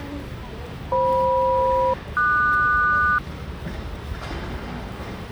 Aircraft SELCAL, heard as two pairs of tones, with the noise of a residential street. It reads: FM-QS